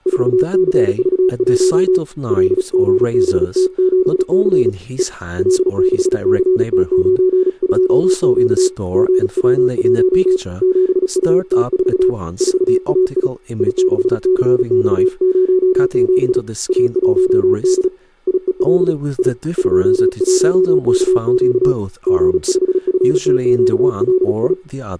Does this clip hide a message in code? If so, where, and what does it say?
Yes: Morse code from 0.0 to 24.6 s, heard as a keyed tone, hand-sent with a paddle, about 36 wpm, 370 Hz, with speech in English. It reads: 4CV1 LGBT7C E L6CT92Q GW1 7UT4 4AI I6CX07 A1D IEL I 21KQ G5FTQLI